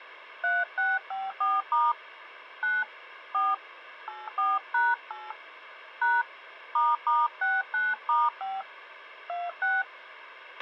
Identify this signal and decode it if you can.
DTMF, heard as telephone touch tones, dialled by hand, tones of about 200 ms, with a squelch burst at the end. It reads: 3654* 9 4 84#8 # **69*5 26